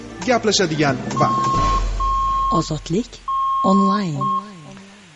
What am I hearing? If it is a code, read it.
Morse code (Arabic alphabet), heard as a keyed tone, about 6 wpm, 1080 Hz, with room echo. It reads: من